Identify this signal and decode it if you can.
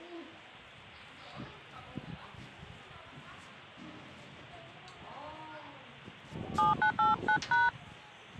DTMF, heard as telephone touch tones, dialled by hand, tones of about 140 ms, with the noise of a park. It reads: 7989#